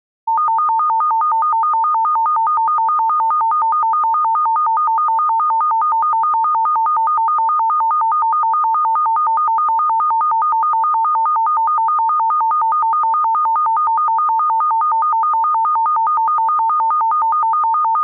A tone that alternates evenly between two pitches. There is no code.